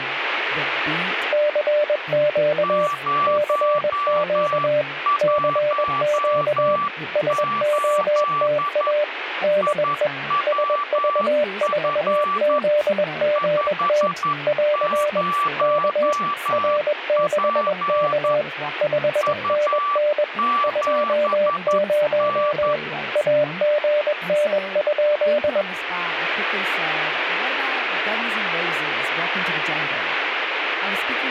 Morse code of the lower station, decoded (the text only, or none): CQ CQ CQ SOTA DE SV4ZGT <AR> K R6K 5NN 20 AGN?